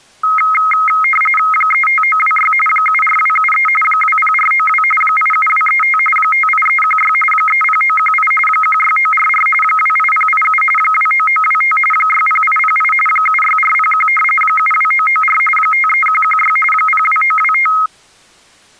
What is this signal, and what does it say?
RTTY (45.45 baud, 850 Hz shift), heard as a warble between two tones, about 1700 Hz centre. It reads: 35926 74273 20492 87235 58316 30918 16944 28087 29925 60808 76401 72994 53116 02925